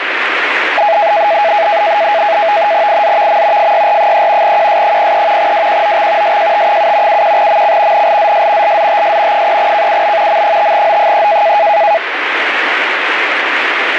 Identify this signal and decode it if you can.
NAVTEX (SITOR-B), 100 baud, 170 Hz shift, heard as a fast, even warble, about 740 Hz centre, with radio static. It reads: IZVM FYR3 QS03 WQOX SJT7 71MC NLZS LZTS 3KUB M5O3